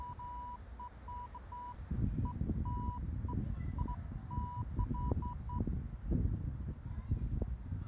Beeps of irregular length, with the noise of a residential street. There is no code.